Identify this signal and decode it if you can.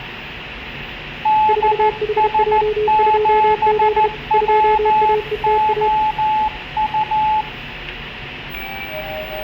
Morse code, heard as two keyed tones, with radio static, room echo and the noise inside a lift. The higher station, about 14 wpm, 860 Hz: DS7WOU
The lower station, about 32 wpm, 430 Hz: 4HJ2Z 2AETA